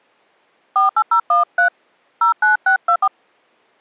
DTMF, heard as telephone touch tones, dialled by hand, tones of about 100 ms. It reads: 48013 09624